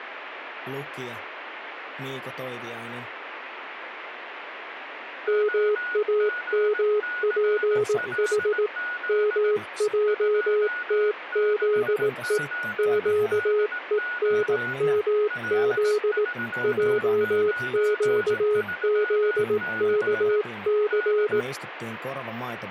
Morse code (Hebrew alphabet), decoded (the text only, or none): מאמפח מעתזו קונמז עקזכס